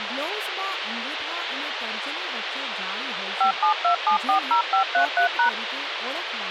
DTMF, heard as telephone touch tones, dialled by machine, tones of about 100 ms, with radio hiss and speech in Gujarati. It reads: 572740533#